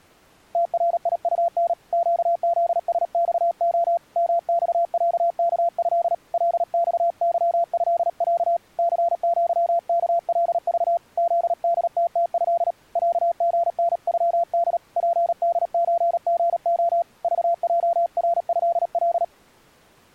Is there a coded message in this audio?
Yes: Morse code (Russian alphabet) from 0.5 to 19.3 s, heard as a keyed tone, hand-sent with a paddle, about 37 wpm, 680 Hz. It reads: ТРИУН ЩЗСЬО МЬЯКЭ ЛЬЫЭЯ ЦЪКЛЖ ЗДТТЭ ЯГНЮД ПДЧГО ЖЙРЭЛ